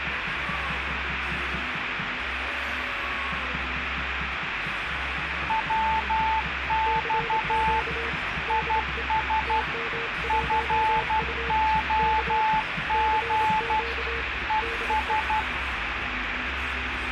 Morse code, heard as two keyed tones, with radio static. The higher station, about 12 wpm, 880 Hz: WX IS FOG ES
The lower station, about 27 wpm, 460 Hz: CQ DE TM1U K CQ DE